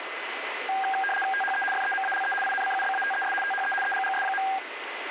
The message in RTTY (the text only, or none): THE FEMALE INCUBATES THE EGGS.